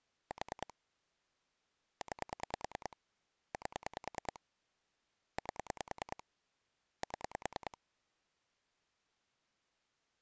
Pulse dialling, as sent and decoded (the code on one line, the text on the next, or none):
4 / 9 / 8 / 8 / 7
4 9 8 8 7